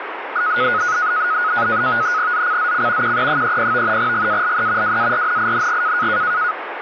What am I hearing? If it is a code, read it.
NAVTEX (SITOR-B), 100 baud, 170 Hz shift, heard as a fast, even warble, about 1360 Hz centre, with radio static. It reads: ZCZC QE30 GALE WARNING